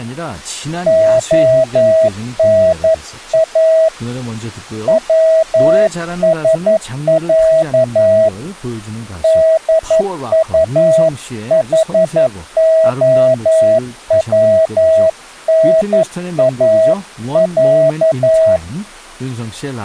Morse code (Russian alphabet), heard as a keyed tone, hand-sent with a paddle, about 11 wpm, 640 Hz, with speech in Korean. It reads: ОНА ВСЯ ДУХОВНАЯ